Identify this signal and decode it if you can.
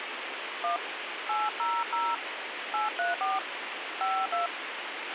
DTMF, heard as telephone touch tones, dialled by hand, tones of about 180 ms, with radio hiss and a squelch burst at the end. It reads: 1 800 834 52